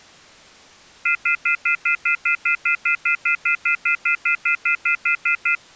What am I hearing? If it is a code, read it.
Telephone call progress tone (North American plan), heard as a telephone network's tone, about 1400, 2050, 2450, 2600 Hz, 0.1 s on and 0.1 s off. Off-hook warning tone.